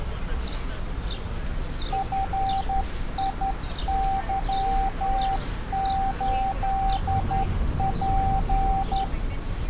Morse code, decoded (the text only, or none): FIY8P